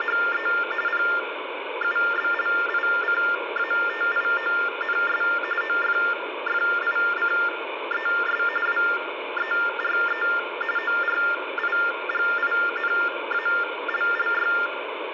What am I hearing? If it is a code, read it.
TTY/TDD text telephone tones (45.45 baud Baudot), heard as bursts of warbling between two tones, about 400 Hz shift, 1600 Hz centre, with phone line noise. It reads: … PUBLICATIONS OFFICES WERE ORIGINALLY